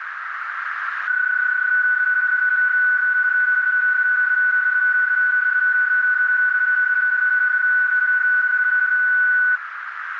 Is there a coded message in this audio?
Yes: PSK31 (31.25 baud) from 1.1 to 9.6 s, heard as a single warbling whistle, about 1490 Hz, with radio static and a narrow filter.